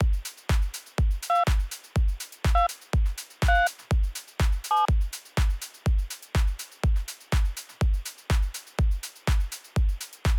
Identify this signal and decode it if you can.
DTMF, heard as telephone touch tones, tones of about 160 ms. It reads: 2 2 3 7